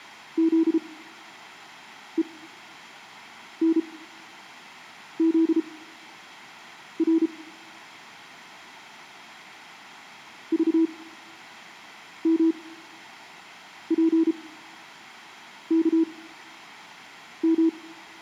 Morse code, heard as a keyed tone, machine-sent, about 33 wpm, spaced as for 6 wpm, 330 Hz, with room echo. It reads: ZENZR VMPKM